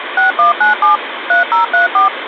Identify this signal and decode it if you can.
DTMF, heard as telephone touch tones, dialled by machine, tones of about 130 ms, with phone line noise. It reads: 6197 3034